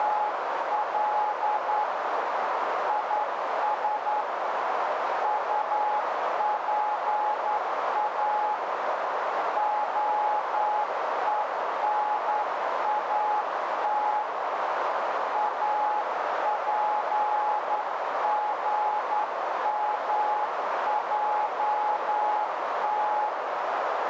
Morse code (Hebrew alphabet), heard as a keyed tone, hand-sent with a straight key, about 10 wpm, 840 Hz, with heavy radio static and a narrow filter. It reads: … יש טפא הונאת אפגמעת